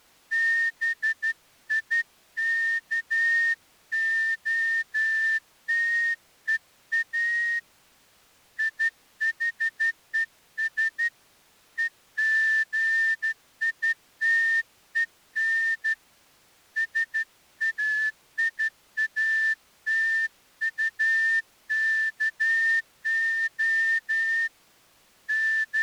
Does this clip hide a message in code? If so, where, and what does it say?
Yes: Morse code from 0.3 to 25.8 s, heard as a whistle, hand-sent with a straight key, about 12 wpm. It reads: BIKOTEA IHES EGITEN SAIATUKO …